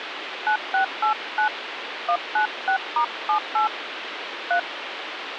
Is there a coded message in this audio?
Yes: DTMF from 0.5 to 4.6 s, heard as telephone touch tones, dialled by hand, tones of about 100 ms, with phone line noise. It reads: 9689 196*78 3